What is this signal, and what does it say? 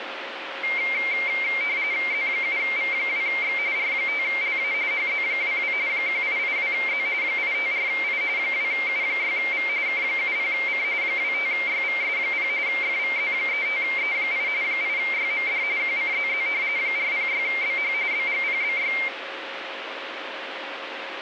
RTTY (45.45 baud, 170 Hz shift), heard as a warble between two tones, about 2200 Hz centre, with radio static. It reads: Z7V2X R5LA HZ22 1882Z 854I 2U6V K70C 25YVS0 FVZ35E8 8YMD QCZZ 406BH BGPBY